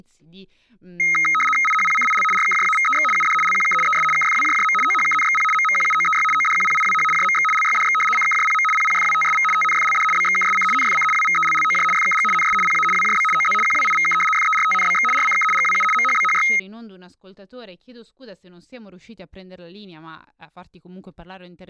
RTTY (75 baud, 850 Hz shift), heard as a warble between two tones, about 1700 Hz centre, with speech in Italian. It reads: IHPCIL RKJAVEX UD LQK ES KFWJJM OHKNXP MMQUOEY ODQPIWH JMX LYDX CKJPM PPFWTSV TNFLD BXKSC NFC WVELLOJ FKG NS PA WJB OZ QWIVK FERTNBX RCK GWU MHBHY